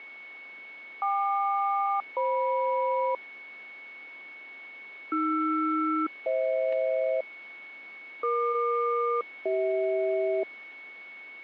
Aircraft SELCAL, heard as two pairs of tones, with a steady whistle near 2210 Hz. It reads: KQ-FM AR-FH EQ-CH